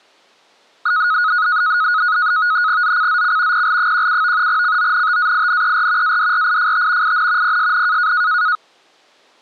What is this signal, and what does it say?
NAVTEX (SITOR-B), 100 baud, 170 Hz shift, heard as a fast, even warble, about 1360 Hz centre. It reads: ZCZC PL17 CONTAINER ADRIFT IN PSN